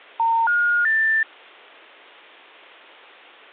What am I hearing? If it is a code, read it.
Telephone call progress tone (North American plan), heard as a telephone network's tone, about 910, 1430, 1800 Hz. Special information tone.